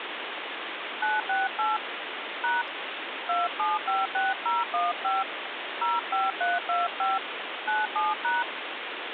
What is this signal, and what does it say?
DTMF, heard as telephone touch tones, dialled by hand, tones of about 180 ms, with phone line noise. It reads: 968 # 2756015 05325 97#